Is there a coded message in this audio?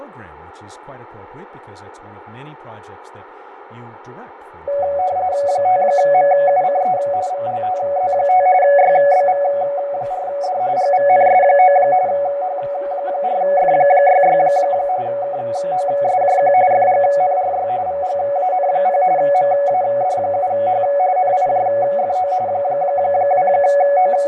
Yes: RTTY (45.45 baud, 170 Hz shift) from 4.7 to 24.3 s, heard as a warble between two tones, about 650 Hz centre, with radio static, fading, room echo and speech in English. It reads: 5MUCE VLTZ5 YBV4D GVNS9 H4F66 KOSJQ FGNRY VGAN0 MAD7H NIJFO …